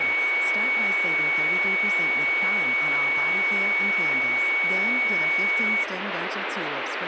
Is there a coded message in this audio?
No, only a steady tone, with radio static and speech in English.